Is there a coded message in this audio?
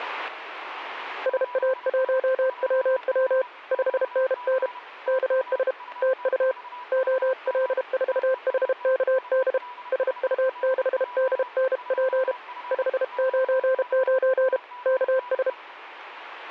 Yes: Morse code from 1.2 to 15.6 s, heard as a keyed tone, hand-sent with a paddle, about 32 wpm, 520 Hz, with a weaker station near 980 Hz. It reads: SA1WW 5NN KS TU OL4HKD SU6DNP 599 KS